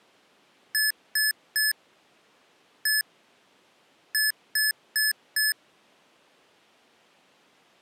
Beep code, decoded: 3-1-4

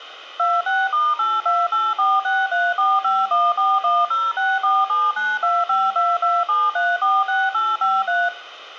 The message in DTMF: 26*828463451410647925227346853

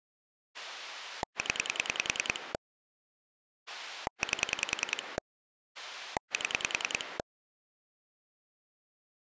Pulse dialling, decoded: 0 8 7

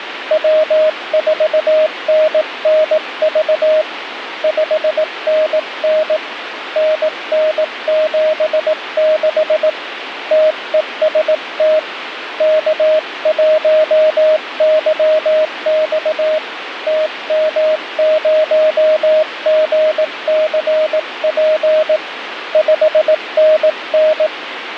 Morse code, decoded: W4NNV 5NN NN76 TEST K1YX TM0GCP 5NN

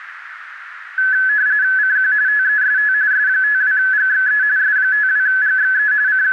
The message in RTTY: CQ TEST S52GXE S52GXE …

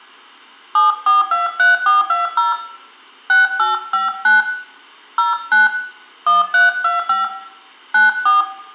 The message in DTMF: 7423420 6859 09 1325 94

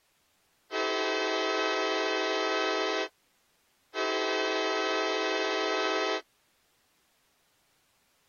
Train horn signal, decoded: 2 long

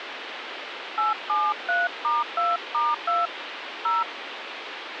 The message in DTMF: 873*2*2 0

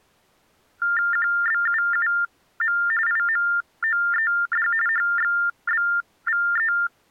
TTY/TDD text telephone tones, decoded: QBUUM IMOED HXBVE

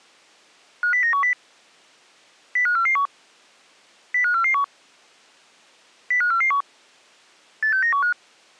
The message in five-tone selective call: 50910 05441 05441 05441 86915

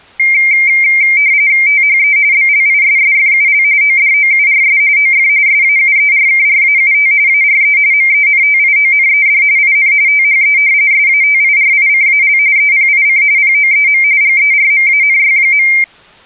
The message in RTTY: THE BLISSFUL ODOURS OF SAUERKRAUT ARE MENTIONED IN THE SATIRICAL EPIC POEM GERMANY.

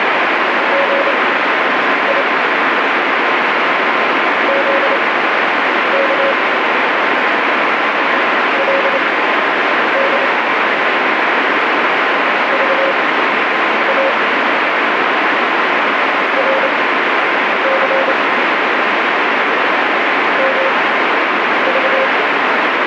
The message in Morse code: GI ZK LD VA RC MV

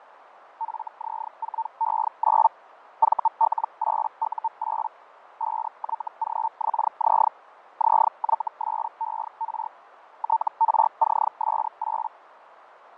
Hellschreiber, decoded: FZ4E9 VL8U8 5YGXZ ZYSER TRCS8

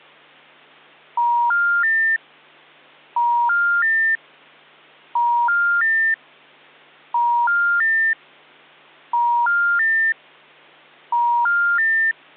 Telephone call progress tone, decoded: special information tone

